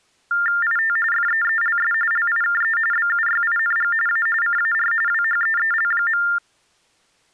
TTY/TDD text telephone tones (45.45 baud Baudot), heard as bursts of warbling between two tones, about 400 Hz shift, 1600 Hz centre. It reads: IT FEELS LIKE BUYING A CAR WHEEL.